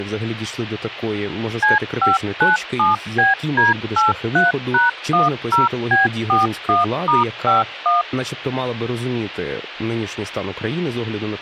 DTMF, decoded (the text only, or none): C597BD83#10B41*51